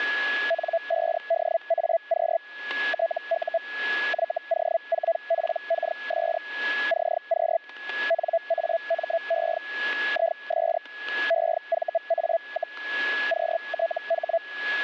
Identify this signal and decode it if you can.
Hellschreiber (Feld-Hell, 122.5 baud), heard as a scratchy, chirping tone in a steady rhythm, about 670 Hz, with static crashes and a steady whistle near 1690 Hz. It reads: N5DAQ TU YO4PKS CQ NAME IS EVA, QTH